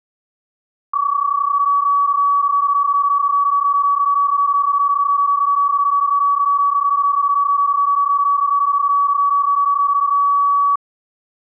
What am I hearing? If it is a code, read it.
PSK31 (31.25 baud), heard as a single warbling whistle, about 1140 Hz.